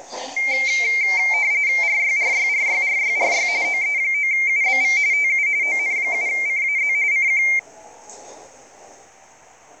RTTY (45.45 baud, 170 Hz shift), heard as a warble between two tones, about 2200 Hz centre, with the noise inside a subway train. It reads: RYRYRYRYRY OE9UBV TU ON7CAZ CQ